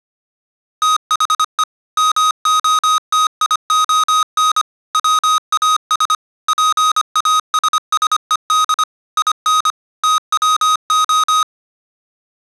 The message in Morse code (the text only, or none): THE MOTION WAS PASSED IN TWO